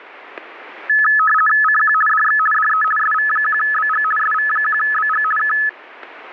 RTTY (50 baud, 450 Hz shift), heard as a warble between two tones, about 1500 Hz centre, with static crashes. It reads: CQ DX DE SV1BG SV1BG K